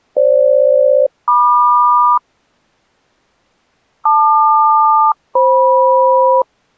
Aircraft SELCAL, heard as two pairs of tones. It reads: FG-MQ LQ-FM